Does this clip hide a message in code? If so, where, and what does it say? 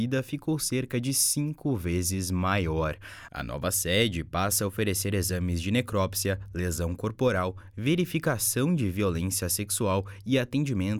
No.